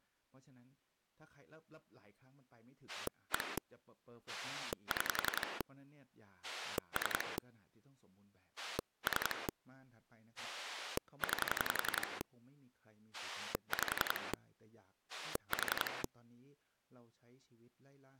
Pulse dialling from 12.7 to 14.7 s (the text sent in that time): 5